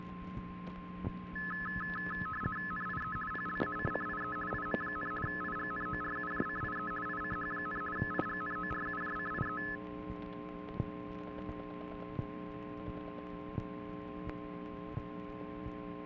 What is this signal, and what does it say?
RTTY (50 baud, 450 Hz shift), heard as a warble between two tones, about 1500 Hz centre, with a steady whistle near 1050 Hz. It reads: NIE PLACCIE IM, IGNORUJCIE ICH, IGNORUJCIE